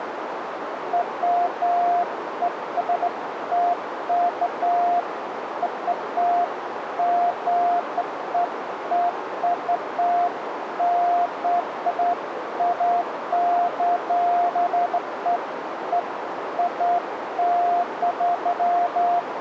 Beeps of irregular length, with radio static and a narrow filter. There is no code.